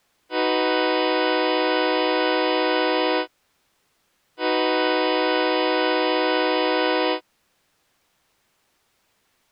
Train horn signal, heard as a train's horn. 2 long. On North American railways: brakes released, proceed.